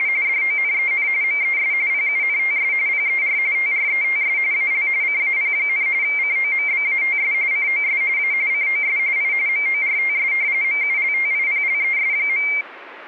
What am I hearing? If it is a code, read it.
RTTY (45.45 baud, 170 Hz shift), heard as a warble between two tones, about 2200 Hz centre. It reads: … DONEN MES PUNTS PER TRETS AL CAP, COMBATS COS A COS I MORTS MULTIPLES.